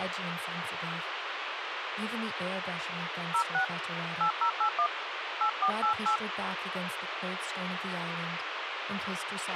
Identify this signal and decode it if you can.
DTMF, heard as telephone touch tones, dialled by hand, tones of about 90 ms, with radio hiss, a squelch burst at the end and speech in English. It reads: 06 8081 8488